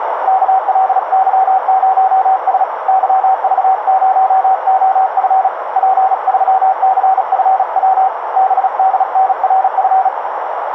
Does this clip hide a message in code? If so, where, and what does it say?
Yes: Morse code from 0.2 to 10.1 s, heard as a keyed tone, hand-sent with a paddle, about 36 wpm, 760 Hz, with radio static and a narrow filter. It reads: KLY0S YV0OF P3CFW BDNRF